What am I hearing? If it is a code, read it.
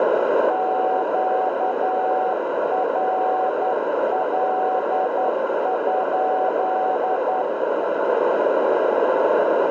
Morse code, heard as a keyed tone, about 10 wpm, 750 Hz, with radio static, a narrow filter and room echo. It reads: QRL?